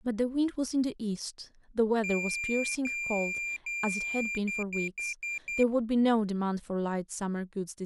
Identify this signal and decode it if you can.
Beep code, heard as a piezo beeper, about 2400 Hz, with speech in English. 3 long, 5 short.